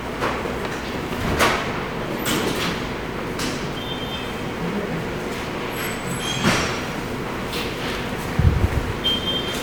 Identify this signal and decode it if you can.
The noise of a subway station. There is no code.